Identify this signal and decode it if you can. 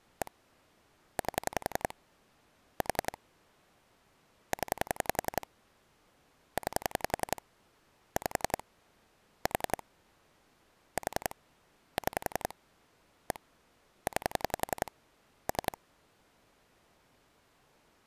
Pulse dialling, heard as clicks on a phone line, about 11 pulses a second. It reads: 1 8 4 0 9 5 4 4 6 1 9 3